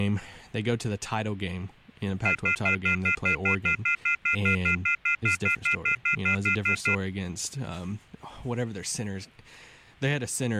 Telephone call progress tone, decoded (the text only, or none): off-hook warning tone